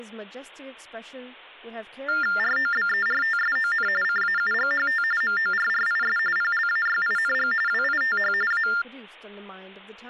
TTY/TDD text telephone tones (45.45 baud Baudot), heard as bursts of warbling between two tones, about 400 Hz shift, 1600 Hz centre, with hum and speech in English. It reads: ROBERTSON CAUGHT MORRIS PLAYING WITH A